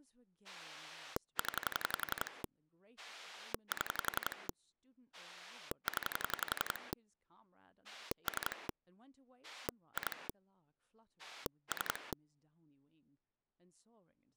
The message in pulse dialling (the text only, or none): 0 7 0 3 2 3